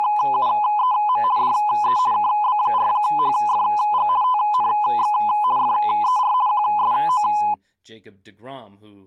RTTY (50 baud, 170 Hz shift), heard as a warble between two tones, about 920 Hz centre, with speech in English. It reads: … DE KB4HFG TNX FER QSO